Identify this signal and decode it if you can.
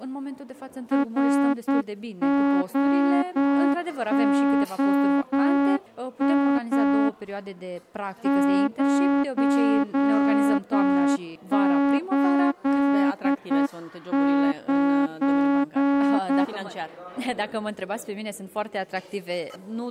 Morse code, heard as a horn, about 9 wpm. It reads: ROOM 089